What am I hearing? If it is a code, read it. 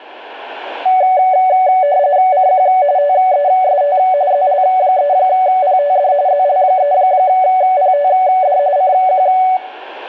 RTTY (45.45 baud, 170 Hz shift), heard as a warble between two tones, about 660 Hz centre, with radio static and room echo. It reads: CQ TEST ZL3PTD ZL3PTD CQ